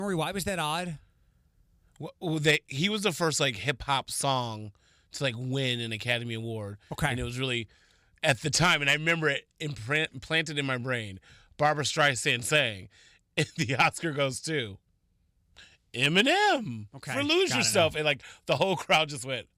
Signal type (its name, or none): none